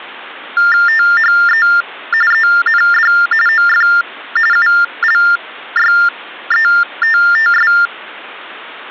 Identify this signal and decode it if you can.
TTY/TDD text telephone tones (45.45 baud Baudot), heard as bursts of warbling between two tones, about 400 Hz shift, 1600 Hz centre. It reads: THE END OF ULYETTS